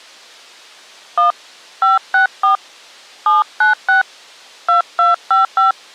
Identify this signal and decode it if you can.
DTMF, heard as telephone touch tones, dialled by hand, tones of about 130 ms. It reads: 1 564 796 2255